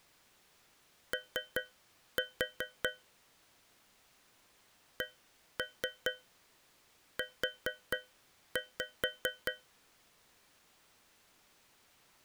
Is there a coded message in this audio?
Yes: tap code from 1.1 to 9.7 s, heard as taps on a metal pipe, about 4 knocks a second. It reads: O CU